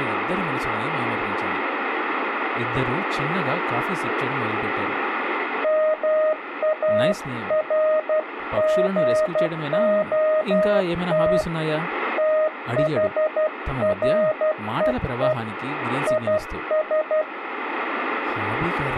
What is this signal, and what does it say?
Morse code, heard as a keyed tone, hand-sent with a paddle, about 12 wpm, 620 Hz, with speech in Tamil. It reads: MARGOT THREE IS